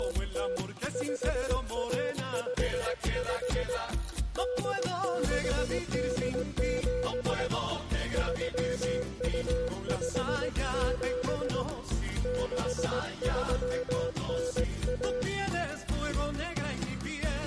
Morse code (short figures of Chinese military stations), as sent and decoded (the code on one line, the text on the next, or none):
… / ..... .- ..... ..... / -.. -.... -.. --... / ...-- ..- ..... --... / -.... ...-- -. .-
… 5155 8687 3257 6391